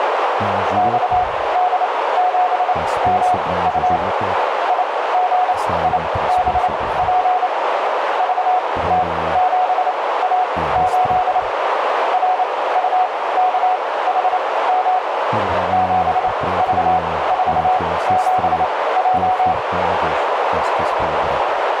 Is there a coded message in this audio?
Yes: Morse code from 0.7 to 19.6 s, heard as a keyed tone, machine-sent, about 28 wpm, spaced as for 18 wpm, 740 Hz, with heavy radio static and a narrow filter. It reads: XD7MU IGIBP VT7A8 RUKHM 7V47J